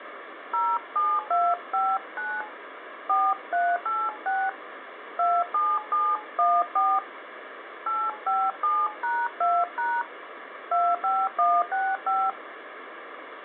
DTMF, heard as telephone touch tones, dialled by hand, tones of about 230 ms, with phone line noise. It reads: 07259 4386 27714 857#2# 25165